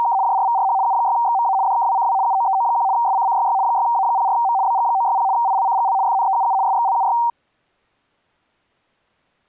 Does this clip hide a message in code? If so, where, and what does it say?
Yes: RTTY (75 baud, 170 Hz shift) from 0.0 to 7.3 s, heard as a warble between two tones, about 860 Hz centre. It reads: … JRVRH U6XMA DKWCW UOEO1 SCCYY 6A04M BG960 ILCGL FNEUU SXLUY